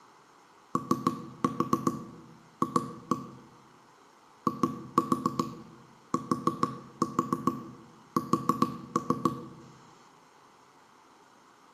Tap code, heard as knocks on wood, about 7 knocks a second, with room echo. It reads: OF ITS